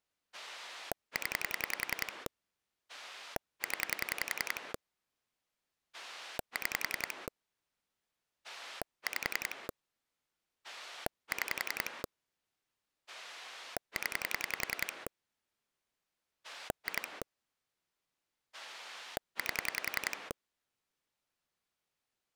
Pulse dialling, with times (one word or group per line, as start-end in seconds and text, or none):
0.3-2.3 0
2.9-4.7 0
5.9-7.3 6
8.4-9.7 5
10.6-12.0 6
13.1-15.1 0
16.4-17.2 2
18.5-20.3 8